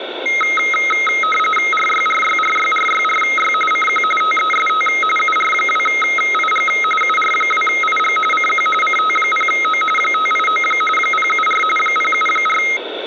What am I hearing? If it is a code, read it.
RTTY (45.45 baud, 850 Hz shift), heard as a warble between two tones, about 1700 Hz centre, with radio static. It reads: RYRYRYRYRY CQ TEST UR2IG UR2IG CQ CT0O 589 074 074